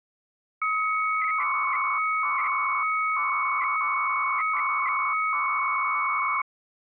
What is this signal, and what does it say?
300-baud modem data (Bell 103 tones), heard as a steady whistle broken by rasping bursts, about 300 baud, 200 Hz shift.